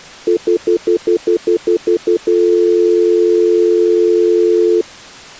Telephone call progress tone (North American plan), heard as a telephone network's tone, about 350, 440 Hz, 0.1 s on and 0.1 s off. Stutter dial tone.